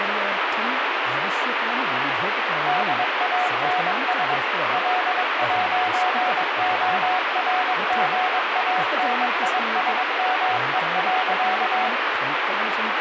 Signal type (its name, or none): Morse code